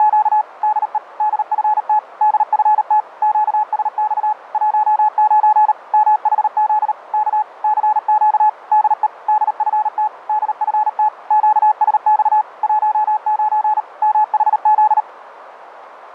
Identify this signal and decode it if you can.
Morse code, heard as a keyed tone, machine-sent, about 38 wpm, 850 Hz, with radio static. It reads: … DE DFT DFT QSX 19 MHZ K CQ DE DFT DFT QSX 19 MHZ